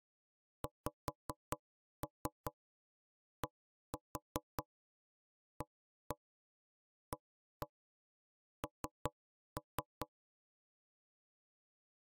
Tap code, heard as knocks on wood, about 5 knocks a second. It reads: XDAAN